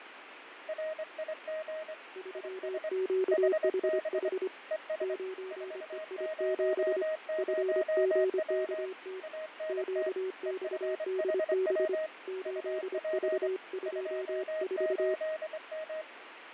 Morse code, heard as two keyed tones, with radio static and fading. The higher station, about 24 wpm, 630 Hz: RIG IS HB ES 400W ANT EFHW UP 28M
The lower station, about 25 wpm, 380 Hz: 3QHH 9EI7 FGKT QXDB 8V24